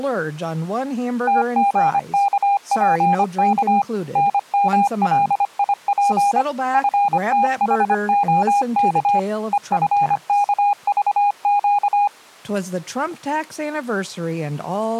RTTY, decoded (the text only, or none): none